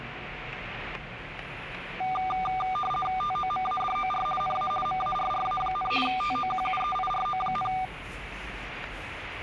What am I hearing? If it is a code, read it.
RTTY (50 baud, 450 Hz shift), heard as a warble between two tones, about 980 Hz centre, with radio static, static crashes and the noise inside a lift. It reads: TOMADOR NA MARRA, TOQUEIRO,